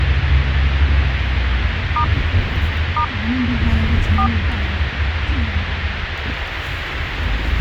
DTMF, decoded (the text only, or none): * * 4